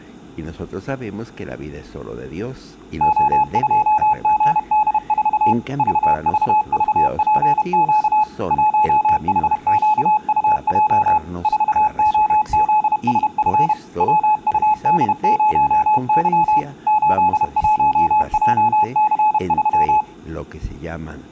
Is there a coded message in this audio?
Yes: Morse code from 2.9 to 20.1 s, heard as a keyed tone, machine-sent, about 31 wpm, 850 Hz. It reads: O2GD4 VVVPQ 1HQUJ 4OZSF WUD0Y 81JC3